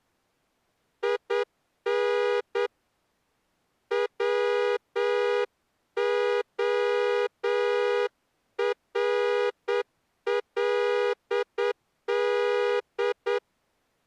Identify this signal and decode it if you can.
Morse code, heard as a horn, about 8 wpm. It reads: IN WORLD